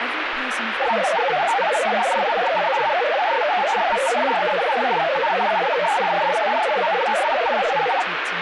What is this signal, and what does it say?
Multi-tone FSK (Olivia or MFSK type), about 500 Hz wide, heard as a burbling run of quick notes, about 62.5 baud, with radio static and speech in English.